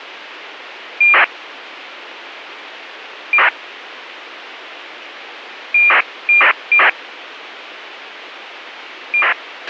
ACARS aircraft data, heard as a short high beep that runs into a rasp, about 2400 baud, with radio hiss and a squelch burst at the end.